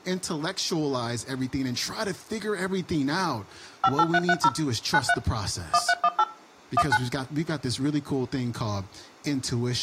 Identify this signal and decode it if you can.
DTMF, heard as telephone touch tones, dialled by machine, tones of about 50 ms, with speech in English. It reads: 58330 93 1318 19